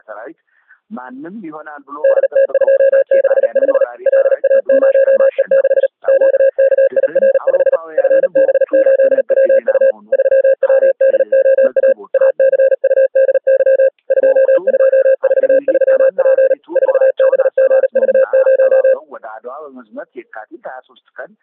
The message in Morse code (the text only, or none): DT265 LA0E6 QKIR5 FB8WU 3WDOA ACUDY 2243P 4BGV0